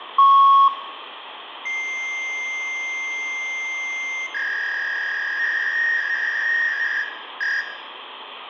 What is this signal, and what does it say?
Fax machine handshake, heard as a beep, a long tone and a warble, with phone line noise and room echo.